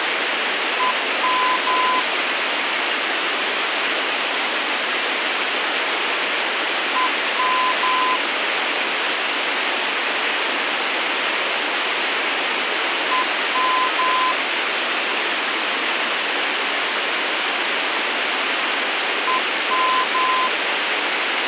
Morse code, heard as a keyed tone, machine-sent, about 11 wpm, 1020 Hz, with radio hiss. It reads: EM EM EM EM